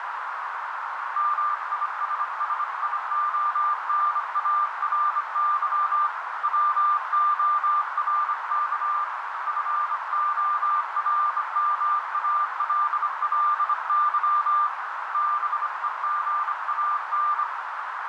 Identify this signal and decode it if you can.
Morse code, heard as a keyed tone, hand-sent with a bug key, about 25 wpm, 1190 Hz, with heavy radio static and a narrow filter. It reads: MISSIONARY WORK FORMALLY BEGAN